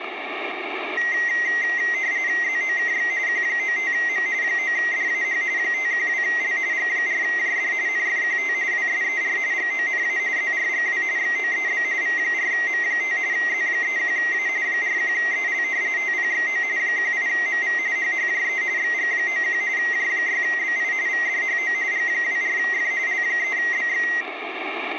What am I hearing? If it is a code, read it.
RTTY (45.45 baud, 170 Hz shift), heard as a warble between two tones, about 2000 Hz centre, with radio static. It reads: ZOKX Q95M 9DAH 512L G4JD NFQT WSER GONA ZRGW XOEB V4M5 Z31A 41EL TPXO 18MV HHJE XG91 J6BI VDHO G24F L3BX